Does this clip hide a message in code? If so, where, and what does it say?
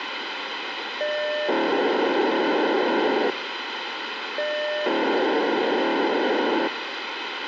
Yes: POCSAG pager data (1200 baud) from 1.0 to 6.7 s, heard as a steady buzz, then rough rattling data, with radio hiss.